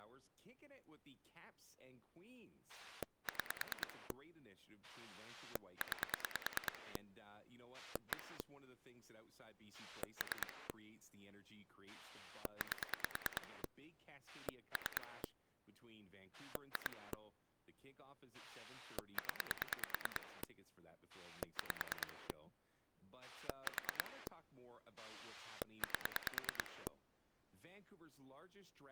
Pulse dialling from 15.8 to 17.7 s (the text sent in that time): 2